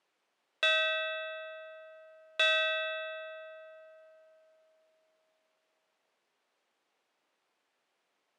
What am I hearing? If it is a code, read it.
Clock strike, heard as a bell. 2. Two o'clock.